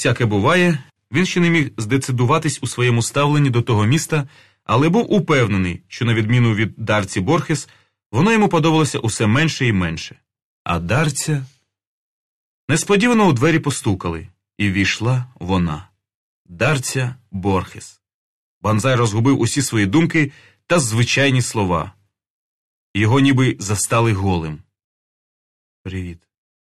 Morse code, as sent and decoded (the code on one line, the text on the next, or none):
none